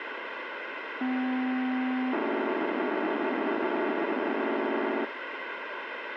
POCSAG pager data (512 baud), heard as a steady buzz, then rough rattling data, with radio hiss.